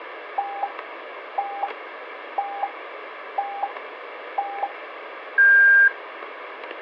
Radio time signal (five pips and a higher one, as on Chinese radio), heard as pips.